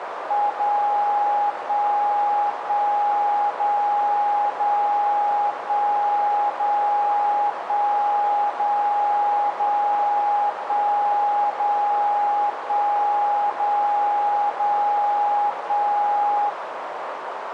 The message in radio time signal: 0 1 1 0 0 1 0 1 0 0 1 0 1 0 0 1

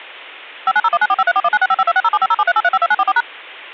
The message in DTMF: 59019453419655260750738352944#

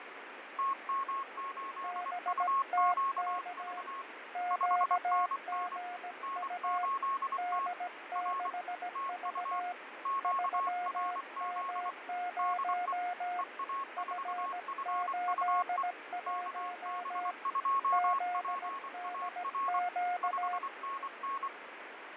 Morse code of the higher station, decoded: TM8UQV 5NN N8T R TU QRZ DE EA4FUE KB2PAR 5NN

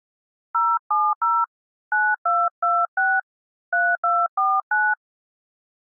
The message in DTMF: 070 9226 3249

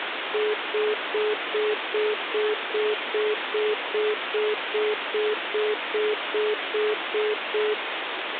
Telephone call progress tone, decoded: congestion tone

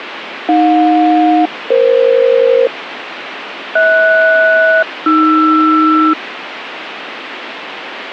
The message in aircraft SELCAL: AJ-EF HS-AR

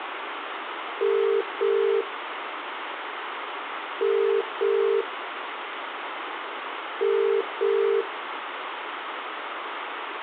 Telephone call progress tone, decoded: ringback tone

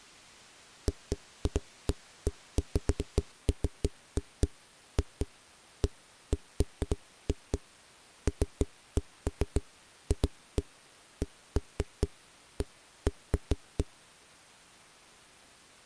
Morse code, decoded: none

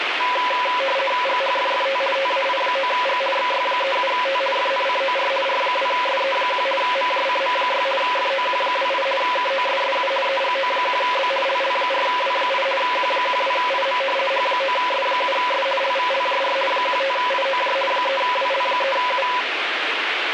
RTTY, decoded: GHFFT TAI9G XY37T FNCOR R2SE1 MJCM6 FOQ28 KOSSU EGO1B LL4W8 Q12IM H9S7S LVLJR 15IOJ 3WL3U

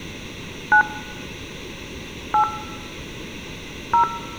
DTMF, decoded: 9 8 0

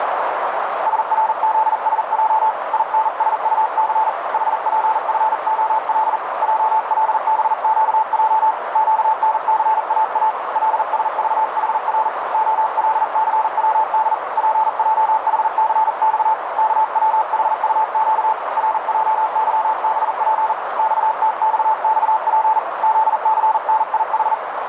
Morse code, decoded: SRZSJ INSUC HPFOL JLBQJ QNCAA LSVHR OLCWD PJHCX KWHUQ RJYBP XTXXP ZCNIH

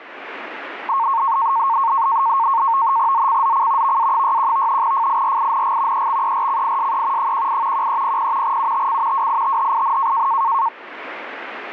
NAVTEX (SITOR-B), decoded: ZCZC VA61 FIRING EXERCISE 18 1300 UTC WITHIN

